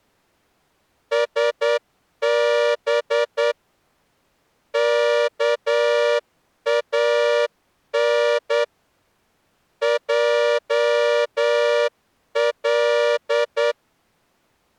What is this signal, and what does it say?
Morse code (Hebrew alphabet), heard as a horn, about 9 wpm. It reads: שב כאן על